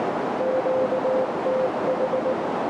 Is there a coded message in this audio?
Yes: Morse code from 0.3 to 2.4 s, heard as a keyed tone, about 19 wpm, 520 Hz, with heavy radio static and a narrow filter. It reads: QTH